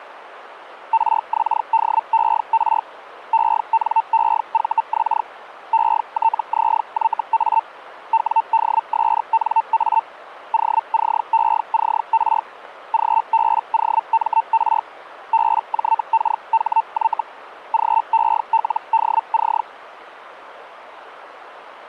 Hellschreiber (Feld-Hell, 122.5 baud), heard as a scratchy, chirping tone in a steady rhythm, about 900 Hz, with radio static. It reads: RXDER ENEVX ETZYA WDSNA OCECR GBOMR BJKHY GELDC